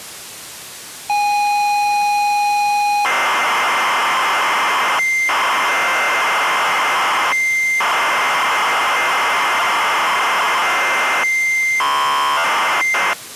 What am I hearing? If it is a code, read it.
ZX Spectrum tape loading, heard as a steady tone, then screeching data.